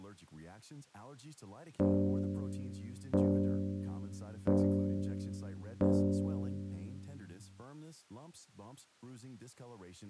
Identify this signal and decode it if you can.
Clock strike, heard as a bell, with speech in Swedish. 4. Four o'clock.